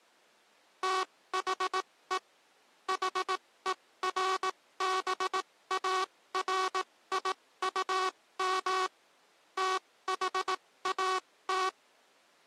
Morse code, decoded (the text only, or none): THE HERBARIUM THAT